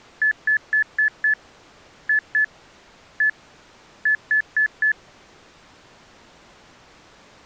Beep code, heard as beeps, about 1750 Hz. 5-2-1-4.